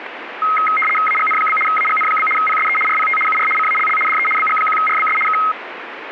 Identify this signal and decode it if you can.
RTTY (75 baud, 850 Hz shift), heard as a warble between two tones, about 1700 Hz centre, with radio static. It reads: AGN? AGN? PSE RPT UR CALL DE BG1RBS K